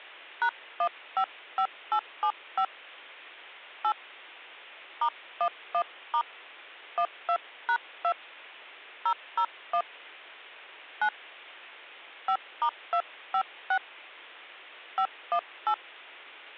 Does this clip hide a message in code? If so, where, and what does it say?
Yes: DTMF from 0.4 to 15.7 s, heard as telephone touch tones, dialled by hand, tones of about 80 ms. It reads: #155875 8 *11* 12#2 001 9 5*256 518